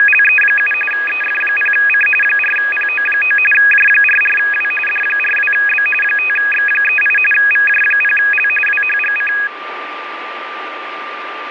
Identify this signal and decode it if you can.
RTTY (45.45 baud, 850 Hz shift), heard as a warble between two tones, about 2100 Hz centre, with radio static and a steady whistle near 1190 Hz. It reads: … EF0C 4PO9 J44W D42B 5X38 VJ0L WHGC